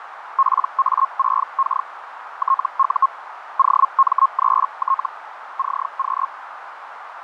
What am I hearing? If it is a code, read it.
Hellschreiber (Feld-Hell, 122.5 baud), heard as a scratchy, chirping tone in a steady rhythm, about 1080 Hz, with radio static, fading and a narrow filter. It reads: PA6K TU OM3T CQ